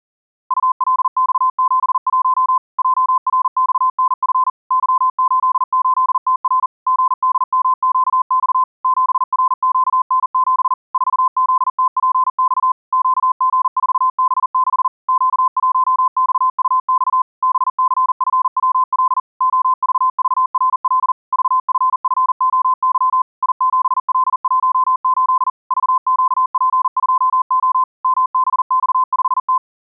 Morse code, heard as a keyed tone, machine-sent, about 40 wpm, 1030 Hz. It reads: ULX71 JRXNF Y88TR GDMQX 7RQN7 4ZTPX QG4B6 Q1XUX BCFWL OVVRL VFFOY I7L18 VQP2O MBX5T